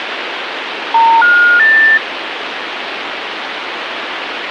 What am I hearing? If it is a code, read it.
Telephone call progress tone (North American plan), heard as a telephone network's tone, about 910, 1430, 1800 Hz, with phone line noise. Special information tone.